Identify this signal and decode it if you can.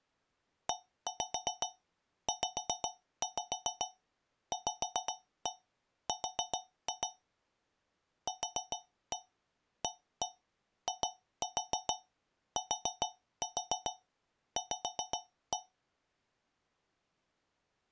Tap code, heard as taps on a metal pipe, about 7 knocks a second. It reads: EZVR QAITV